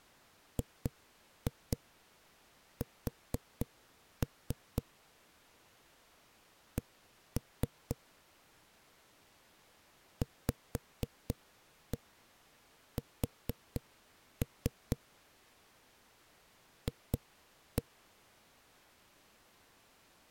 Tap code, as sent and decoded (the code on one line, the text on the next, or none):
2-2 4-3 / 1-3 / 5-1 4-3 / 2-1
GS C VS F